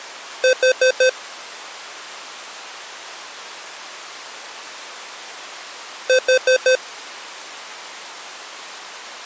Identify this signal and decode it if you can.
Alarm pattern, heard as an alarm's beeps, played twice, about 510 Hz. Temporal four. Carbon monoxide.